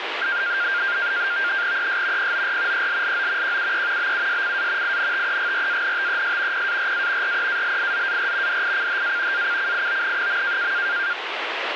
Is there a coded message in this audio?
Yes: NAVTEX (SITOR-B), 100 baud, 170 Hz shift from 0.2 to 11.1 s, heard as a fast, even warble, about 1500 Hz centre, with radio static. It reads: ES POR ELLO QUE BUSCA INTEGRANTES PARA REALIZAR DICHA ACCION.